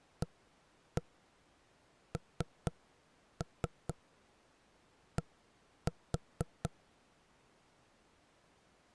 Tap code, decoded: AND

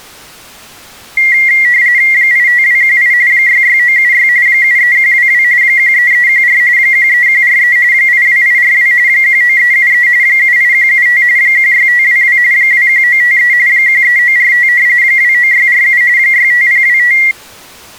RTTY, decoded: 85218 66976 73122 13314 13143 82842 19373 78175 16522 21953 13945 29647 65025

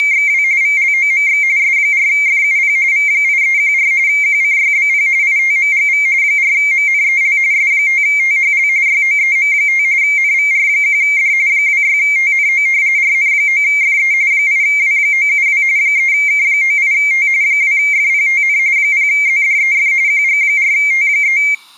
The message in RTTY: … VLOMX S4FUP V8314 QCYBP ITMGV 4MNEL S5THL YOEM5 NVR1D 26TNO RN9FE 8W972 3K98T 2FPTN 0ZDEF QG4T3

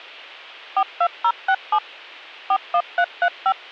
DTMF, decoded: 42067 41335

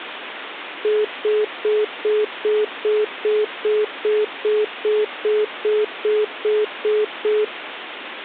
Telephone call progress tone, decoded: congestion tone

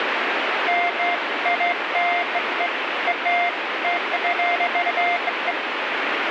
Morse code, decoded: none

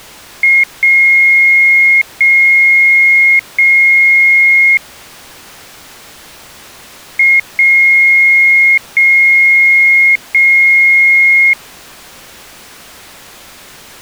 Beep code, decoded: 1 short, 3 long

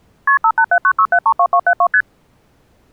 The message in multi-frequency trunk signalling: KP 58796732272 ST

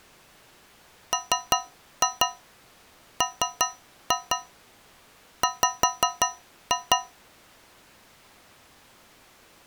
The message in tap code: MMW

